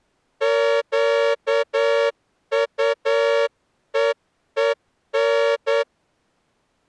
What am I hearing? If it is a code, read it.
Morse code, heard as a horn, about 9 wpm. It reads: QUEEN